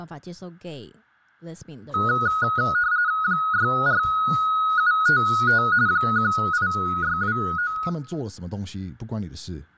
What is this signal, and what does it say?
RTTY (45.45 baud, 170 Hz shift), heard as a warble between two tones, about 1360 Hz centre, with room echo and speech in Chinese. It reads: 64755 18629